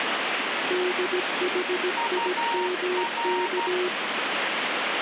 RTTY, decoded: none

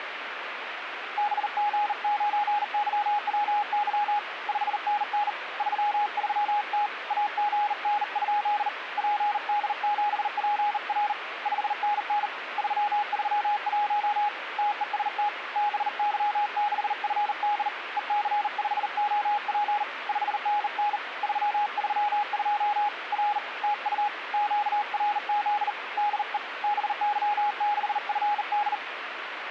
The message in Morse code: BG9YWY 5NN 33T AGN? PD7PR 5NN 331 TEST BY6FD EC5OP 5NN 332 R TU QRZ DE BY6FD

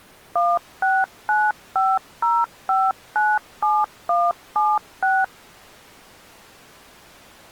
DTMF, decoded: 16950597176

